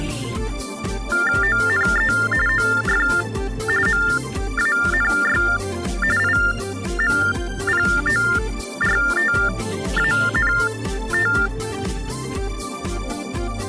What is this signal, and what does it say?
TTY/TDD text telephone tones (45.45 baud Baudot), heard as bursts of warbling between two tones, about 400 Hz shift, 1600 Hz centre. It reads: ONE OF MANY IMPORTANT